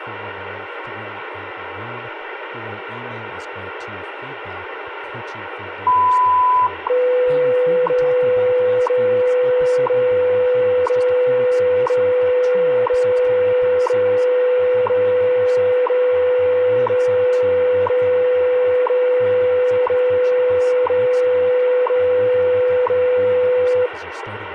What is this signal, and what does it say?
Radio time signal (WWV, Colorado), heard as ticks, one a second, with radio static and speech in English.